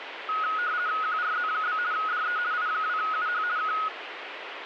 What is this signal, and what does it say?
RTTY (50 baud, 170 Hz shift), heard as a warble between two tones, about 1360 Hz centre, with radio static. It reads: QRZ? DE I2UH K